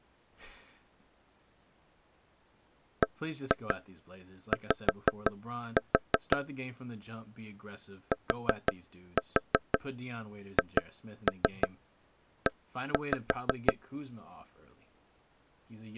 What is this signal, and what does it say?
Tap code, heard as taps on a table, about 5 knocks a second, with speech in English. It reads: BY THE